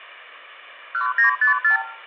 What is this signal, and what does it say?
Multi-frequency trunk signalling (R2, with the far end's replies), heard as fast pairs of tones, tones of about 120 ms, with room echo. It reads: 1954